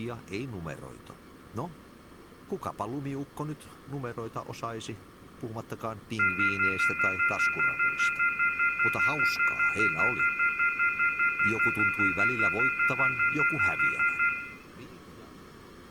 Telephone call progress tone (North American plan), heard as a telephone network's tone, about 1400, 2050, 2450, 2600 Hz, 0.1 s on and 0.1 s off, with room echo. Off-hook warning tone.